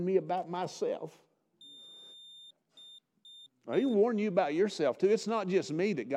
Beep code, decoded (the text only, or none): 1 long, 3 short